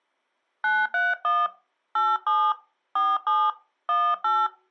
DTMF, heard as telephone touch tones, dialled by hand, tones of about 220 ms. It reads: 931 87 47 18